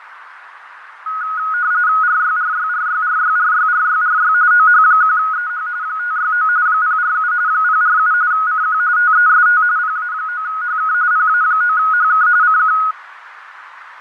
RTTY (45.45 baud, 170 Hz shift), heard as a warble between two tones, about 1360 Hz centre, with radio static, fading and a narrow filter. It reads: RYRYRYRYRYRYRY OH1EH 569 047 047 CQ TEST PA9HK PA9HK CQ